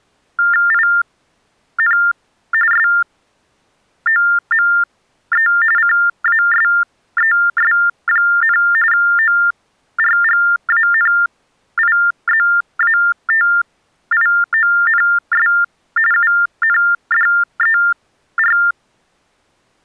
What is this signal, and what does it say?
TTY/TDD text telephone tones (45.45 baud Baudot), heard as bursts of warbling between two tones, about 400 Hz shift, 1600 Hz centre. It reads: IN SOME CASES, ORGANIZATIONS UNDER